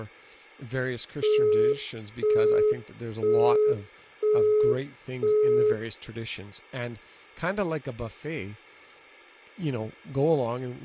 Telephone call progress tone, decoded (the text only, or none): busy tone